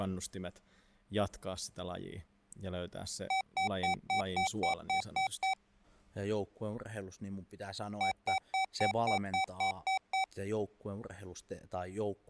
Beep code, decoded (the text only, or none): 9 short